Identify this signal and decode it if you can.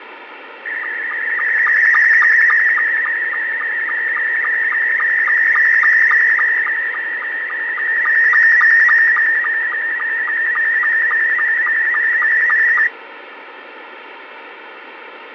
SSTV (slow-scan television), Scottie S2, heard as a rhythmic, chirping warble, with radio static and fading.